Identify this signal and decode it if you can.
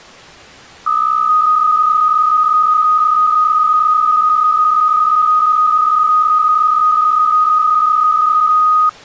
PSK63 (62.5 baud), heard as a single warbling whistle, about 1250 Hz.